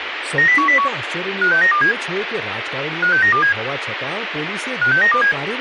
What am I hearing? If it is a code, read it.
Five-tone selective call (CCIR), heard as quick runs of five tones, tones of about 100 ms, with radio hiss and speech in Gujarati. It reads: 90101 56927 56927 56927